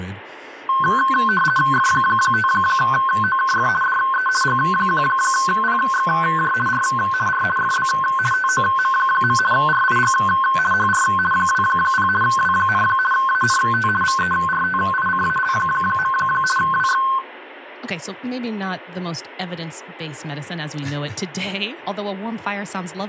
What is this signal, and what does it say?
RTTY (50 baud, 450 Hz shift), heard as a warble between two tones, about 1290 Hz centre, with speech in English. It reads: F5OKF DE G1PXJ R R FB TOM. RIG HR 20 W, ANT VERTICAL. WX